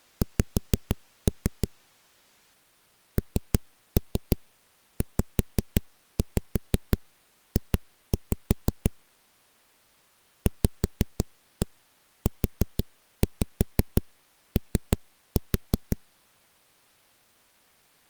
Tap code, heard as knocks on a wall, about 6 knocks a second. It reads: X NZJ VUO